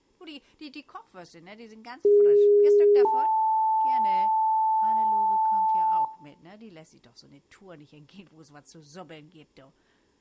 Two-tone page, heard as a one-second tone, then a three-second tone, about 410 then 880 Hz, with room echo.